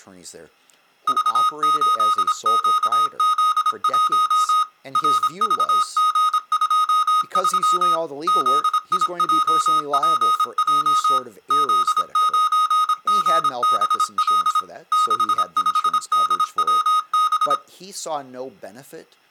Morse code, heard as electronic beeps, machine-sent, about 26 wpm, 1250 Hz, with speech in English. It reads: V8QZ1 RVG23 ZIJPJ Z9GBL 65DWB